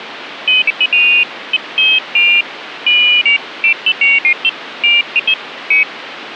Pairs of high tones at irregular times, with phone line noise. There is no code.